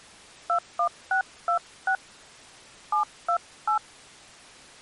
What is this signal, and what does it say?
DTMF, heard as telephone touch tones, dialled by hand, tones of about 100 ms. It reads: 21626 728